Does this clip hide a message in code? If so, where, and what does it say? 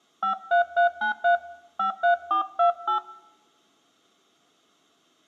Yes: DTMF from 0.2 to 3.0 s, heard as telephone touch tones, dialled by hand, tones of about 110 ms, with room echo. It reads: 53393 53428